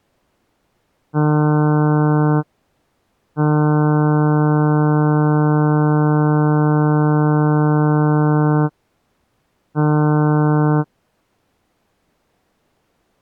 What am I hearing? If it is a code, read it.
Ship horn signal, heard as a ship's horn, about 150 Hz. 1 short, 1 long, 1 short. At sea: a vessel at anchor warns of its position.